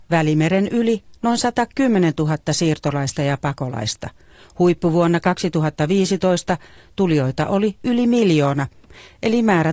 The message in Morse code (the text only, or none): none